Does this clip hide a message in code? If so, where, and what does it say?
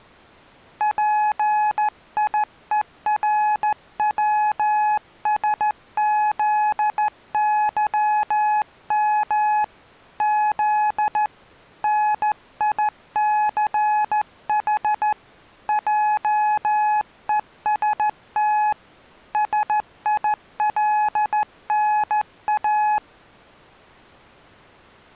Yes: Morse code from 0.7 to 23.0 s, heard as a keyed tone, hand-sent with a straight key, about 14 wpm, 850 Hz. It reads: PIERWSZYM Z NICH JEST SILNA